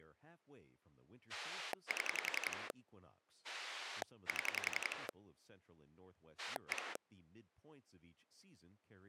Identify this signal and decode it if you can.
Pulse dialling, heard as a rotary dial, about 11 pulses a second, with speech in English. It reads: 7 7 1